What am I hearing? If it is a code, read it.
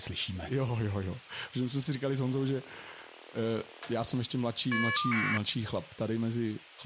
Caller ID data burst, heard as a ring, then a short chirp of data, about 1200 baud, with speech in Czech.